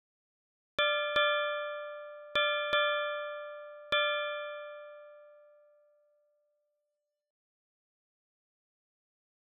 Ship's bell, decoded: 5

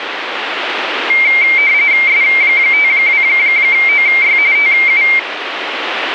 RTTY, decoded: S52OY TU

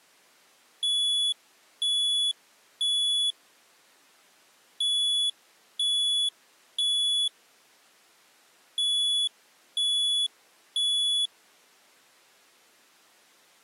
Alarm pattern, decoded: temporal three

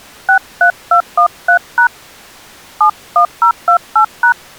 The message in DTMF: 63213# 71028#

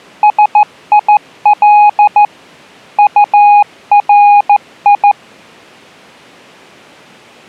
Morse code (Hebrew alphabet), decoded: שיל טרי

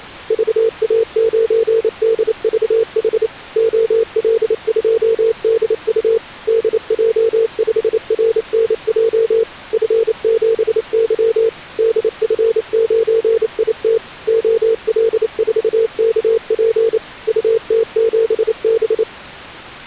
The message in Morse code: VA9DVH OL2DU DJ5RNJ F7Y DF9IT OL4KP UT7B

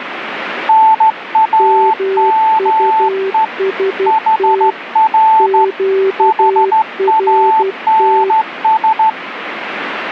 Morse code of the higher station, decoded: NAME HR HANS

